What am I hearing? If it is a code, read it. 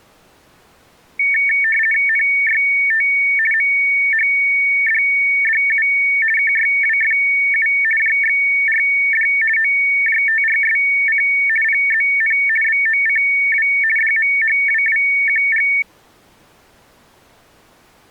RTTY (50 baud, 450 Hz shift), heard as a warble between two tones, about 2000 Hz centre. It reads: NYT MHDDU KYWFU JXRD OJTRSC PZN BOCW DMHWWQG